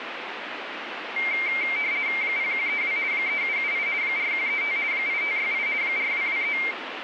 RTTY (50 baud, 170 Hz shift), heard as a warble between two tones, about 2200 Hz centre, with radio static. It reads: 0132 3778 4135 8568 4223